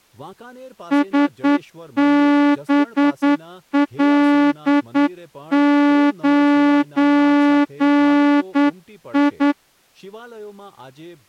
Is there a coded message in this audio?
Yes: Morse code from 0.9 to 9.6 s, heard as a horn, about 9 wpm, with speech in Gujarati. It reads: SBL9I